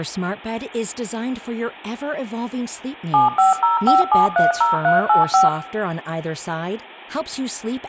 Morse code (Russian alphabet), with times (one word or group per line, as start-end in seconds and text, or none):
none